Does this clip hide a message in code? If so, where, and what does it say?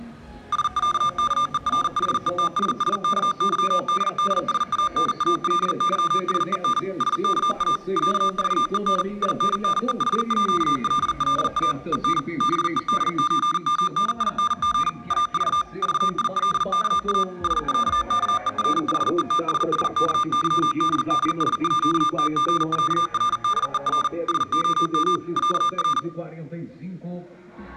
Yes: Morse code (with Swedish letters) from 0.5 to 26.1 s, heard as electronic beeps, machine-sent, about 40 wpm, 1200 Hz. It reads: SÄKERHETSSKYDDSANALYSEN SKA ÄVEN INNEHÅLLA EN BEDÖMNING AV VILKA SÄKERHETSSKYDDSÅTGÄRDER SOM ÄR